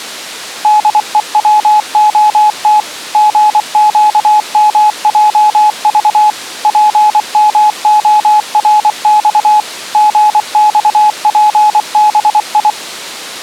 Morse code, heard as a keyed tone, machine-sent, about 24 wpm, 850 Hz. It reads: DEWOT GQMJV PMORX GXPBI